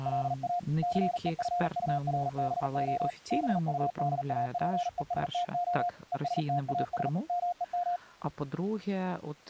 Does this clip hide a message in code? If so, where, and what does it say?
Yes: Morse code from 0.0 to 8.0 s, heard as a keyed tone, hand-sent with a paddle, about 40 wpm, 710 Hz, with speech in Ukrainian. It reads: LA CEFURBO BUDAPESTO ESTAS MEM